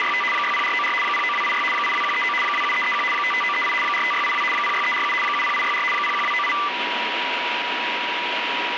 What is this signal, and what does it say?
RTTY (75 baud, 850 Hz shift), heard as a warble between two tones, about 1600 Hz centre, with radio static and a steady whistle near 970 Hz. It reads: … 60494 09286 82139 27331 55938 45682 06347 70864 01298